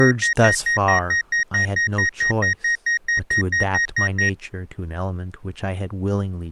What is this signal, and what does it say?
Evenly repeated beeps, with speech in English. There is no code.